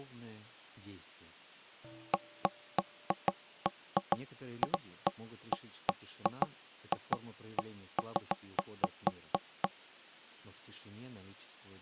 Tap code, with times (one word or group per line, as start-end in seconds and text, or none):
none